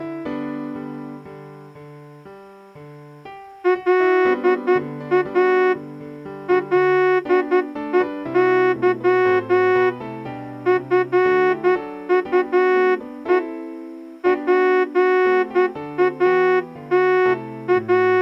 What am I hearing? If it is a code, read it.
Morse code, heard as a horn, hand-sent with a straight key, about 11 wpm. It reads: LA LEY FUE …